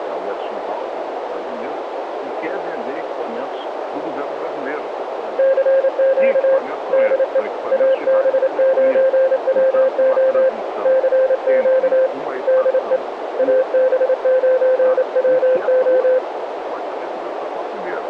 Morse code, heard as a keyed tone, hand-sent with a paddle, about 28 wpm, 520 Hz, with radio static and a narrow filter. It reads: CQ DE AB9WO CQ DE AB9WO